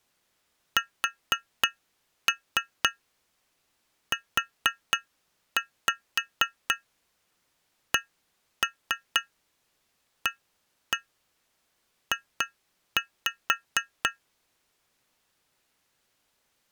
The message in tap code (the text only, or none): SUCAJ